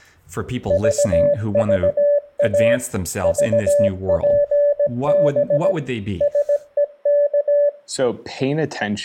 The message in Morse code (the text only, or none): VVA VPB SEK